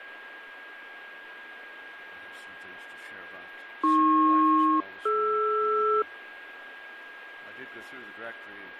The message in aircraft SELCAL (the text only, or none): AP-DR